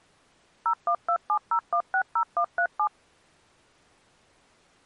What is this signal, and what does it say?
DTMF, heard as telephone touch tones, dialled by machine, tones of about 80 ms. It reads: 01270160137